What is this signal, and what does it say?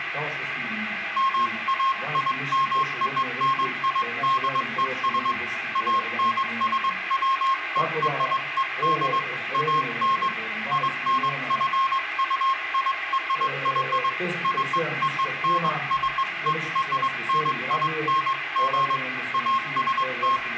Morse code (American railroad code), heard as a keyed tone, hand-sent with a straight key, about 1070 Hz, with radio static and room echo. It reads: MAIMONIDES ANSWERED AN INQUIRY CONCERNING …